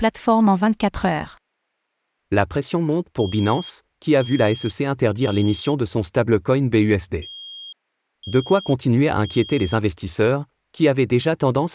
Alarm pattern, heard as an alarm's beeps, played twice, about 3250 Hz, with speech in French. Temporal three. Smoke or fire, evacuate.